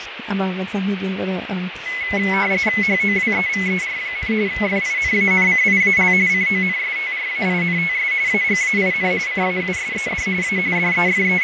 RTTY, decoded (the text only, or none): HOWEVER, FINANCIAL CONSTRAINTS AGAIN CAUSED A …